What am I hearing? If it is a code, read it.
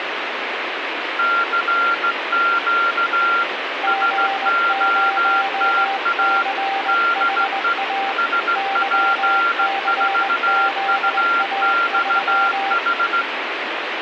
Morse code, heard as two keyed tones, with radio static. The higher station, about 16 wpm, 1380 Hz: CQ SOTA DE SP4UXH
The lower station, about 20 wpm, 780 Hz: G0CHA YCZA3